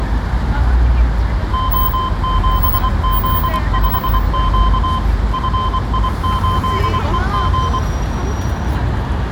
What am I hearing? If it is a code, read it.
Morse code, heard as a keyed tone, machine-sent, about 24 wpm, 1040 Hz, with room echo and street noise. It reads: O7Z5Q FI8EG